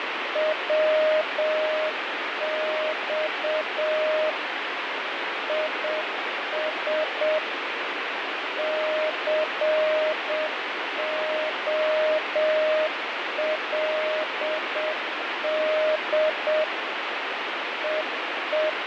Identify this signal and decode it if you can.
Morse code, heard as a keyed tone, machine-sent, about 7 wpm, 620 Hz, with heavy radio static and fading. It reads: WX IS COLD …